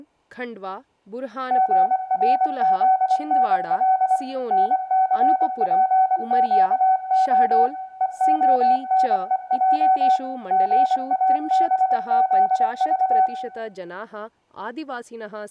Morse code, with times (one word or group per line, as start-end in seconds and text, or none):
1.5-4.2 GRZNL
4.5-7.7 NCPQO
8.0-10.2 EONEJ
10.5-13.3 GABZV